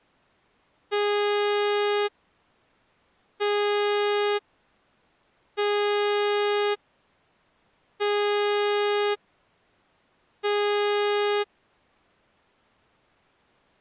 Ship horn signal, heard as a ship's horn, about 410 Hz. 5 short. At sea: I doubt that you are doing enough to avoid a collision.